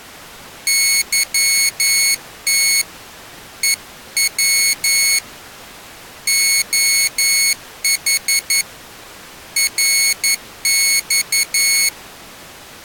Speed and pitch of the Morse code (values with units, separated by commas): 11 wpm, 2200 Hz